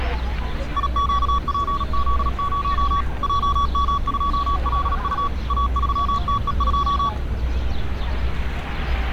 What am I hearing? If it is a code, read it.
Morse code, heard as a keyed tone, machine-sent, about 37 wpm, 1130 Hz, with static crashes and street noise. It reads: IQPZ0 JM2LU A3TE2